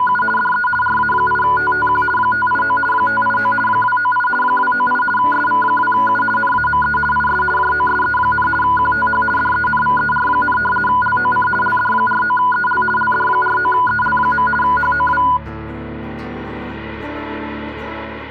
RTTY (50 baud, 450 Hz shift), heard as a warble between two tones, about 1220 Hz centre. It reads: … DE RA8TTQ 589 589 298 298 SV2U NAME IS JOSE, QTH DENVER, LOC LD49EL LD49EL. HOW